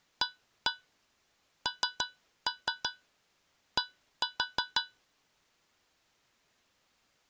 Tap code, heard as taps on a metal pipe, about 5 knocks a second. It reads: AND